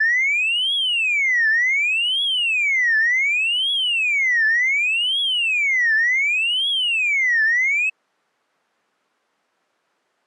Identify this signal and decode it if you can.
A tone that sweeps in pitch again and again. There is no code.